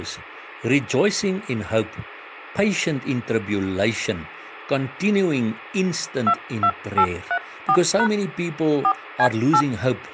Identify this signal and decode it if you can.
DTMF, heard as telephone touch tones, dialled by hand, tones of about 70 ms, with speech in English. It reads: 22834# 4C8